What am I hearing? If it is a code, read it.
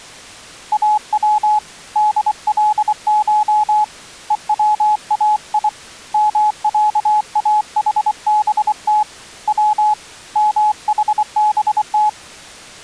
Morse code (Persian alphabet), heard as a keyed tone, hand-sent with a paddle, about 24 wpm, 850 Hz. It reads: او دلش هوای مصاحبت و محبت